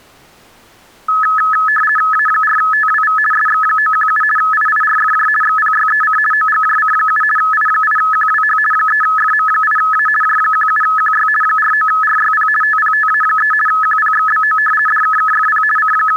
RTTY (50 baud, 450 Hz shift), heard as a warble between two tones, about 1500 Hz centre. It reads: A4TWV SX917 IIRFJ XPYEC OGJC7 I8QWH 3FM8A J17QY 49RYP TPTA3 QPXBO DKKFP …